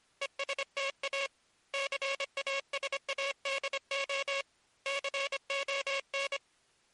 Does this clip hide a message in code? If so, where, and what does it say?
Yes: Morse code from 0.2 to 6.4 s, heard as a buzzer, hand-sent with a paddle, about 25 wpm. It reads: ESTA CASADO CON